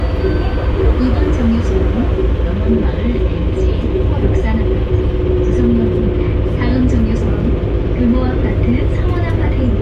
The noise inside a bus. There is no code.